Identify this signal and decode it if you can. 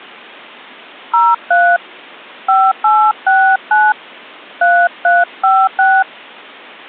DTMF, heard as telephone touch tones, dialled by hand, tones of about 240 ms. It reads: 03 5869 3356